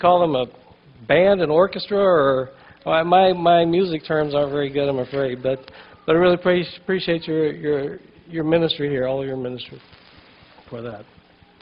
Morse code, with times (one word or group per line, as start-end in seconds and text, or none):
none